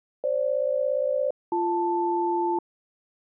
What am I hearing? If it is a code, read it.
Aircraft SELCAL, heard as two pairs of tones. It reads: FG-BL